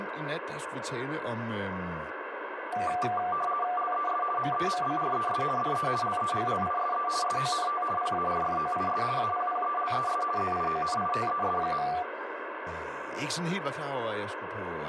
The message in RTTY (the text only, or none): LES MEMBRES DE LEGLISE SONT PARFOIS APPELES ZIONITES.